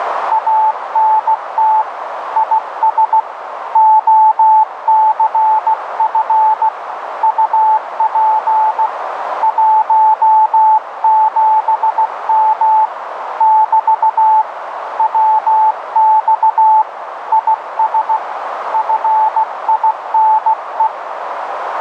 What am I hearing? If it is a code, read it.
Morse code, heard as a keyed tone, hand-sent with a paddle, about 16 wpm, 870 Hz, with radio static and a narrow filter. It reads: ANT IS OCF UP 17M <BT> WX IS FINE